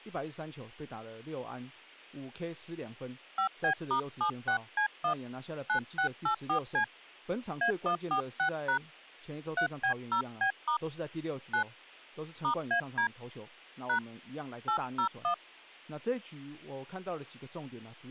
DTMF, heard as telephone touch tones, dialled by hand, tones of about 100 ms, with speech in Chinese. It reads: 5B*76C1 9684C A146# 3B0B* 9 *AD # 801